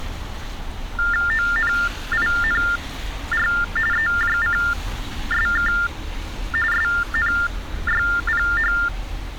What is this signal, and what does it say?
TTY/TDD text telephone tones (45.45 baud Baudot), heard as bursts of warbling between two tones, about 400 Hz shift, 1600 Hz centre, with street noise. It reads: ONINR EJCSK SNYPH